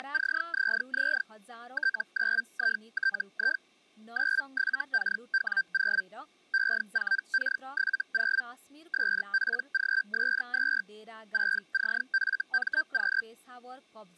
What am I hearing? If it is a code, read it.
Hellschreiber (Feld-Hell, 122.5 baud), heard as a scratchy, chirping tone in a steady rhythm, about 1550 Hz, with speech in Nepali. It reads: … T9ITI 97KW0 E4K70 SPGS2 6CFMQ